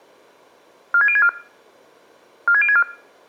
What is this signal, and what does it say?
Five-tone selective call (ZVEI), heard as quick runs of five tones, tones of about 70 ms. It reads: 46064 46064